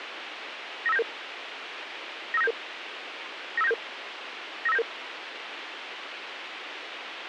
Five-tone selective call (EIA), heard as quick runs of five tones, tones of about 30 ms, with radio hiss and a squelch burst at the end. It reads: 95977 95977 95977 95977